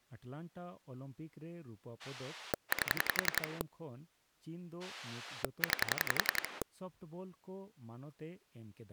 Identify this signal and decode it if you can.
Pulse dialling, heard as a rotary dial, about 11 pulses a second, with speech in Santali. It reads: 8 9